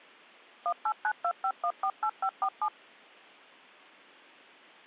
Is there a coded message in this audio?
Yes: DTMF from 0.7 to 2.7 s, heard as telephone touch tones, dialled by machine, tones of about 70 ms. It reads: 18925148547